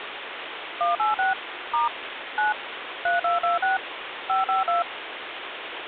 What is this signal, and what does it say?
DTMF, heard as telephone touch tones, dialled by machine, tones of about 150 ms, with phone line noise. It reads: 186 * 9 3226 552